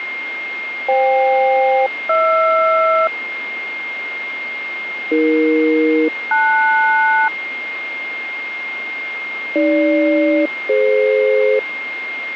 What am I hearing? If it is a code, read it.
Aircraft SELCAL, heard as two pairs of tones, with radio static and a steady whistle near 2120 Hz. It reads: FK-HR AE-LS AG-DF